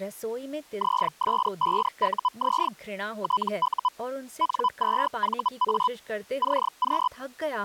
Hellschreiber (Feld-Hell, 122.5 baud), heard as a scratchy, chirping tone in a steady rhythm, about 1000 Hz, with speech in Hindi. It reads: ZS5UZ TU N2VA CQ